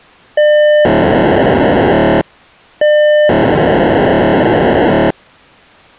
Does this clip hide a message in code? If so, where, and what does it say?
Yes: POCSAG pager data (1200 baud) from 0.4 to 5.1 s, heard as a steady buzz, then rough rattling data.